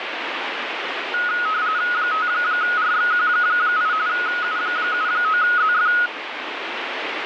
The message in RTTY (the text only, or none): 5RXQ8 U79ZF